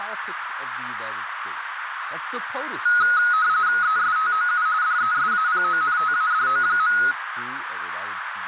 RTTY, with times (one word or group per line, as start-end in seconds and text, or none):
3.8-4.7 ESTOU
4.8-7.0 DESAPONTADO.